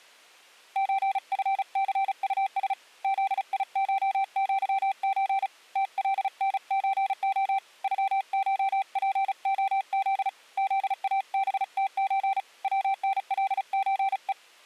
Morse code (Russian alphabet), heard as a keyed tone, hand-sent with a paddle, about 35 wpm, 780 Hz. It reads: ЧФЦУС ЗИШЪЧ ТЛНЧО ЮШПОЗ ЗАБТЧ ВНЛЧЕ